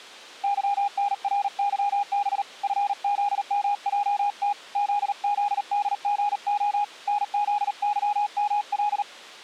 Morse code, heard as a keyed tone, hand-sent with a paddle, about 38 wpm, 820 Hz. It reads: YNRYB FZMJT ZZDGO NZYML